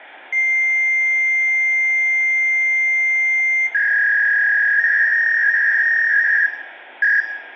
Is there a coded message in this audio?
Yes: fax machine handshake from 0.3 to 7.2 s, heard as a long tone and a warble, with phone line noise and room echo.